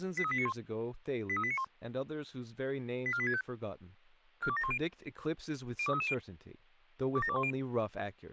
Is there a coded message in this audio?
Yes: five-tone selective call (ZVEI) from 0.2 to 7.5 s, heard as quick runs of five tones, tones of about 70 ms, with speech in English. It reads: 83891 83891 84865 42710 02330 27210